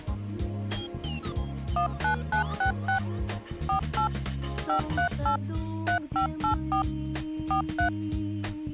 DTMF, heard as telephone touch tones, dialled by machine, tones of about 100 ms. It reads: 19966 48 538 3584 43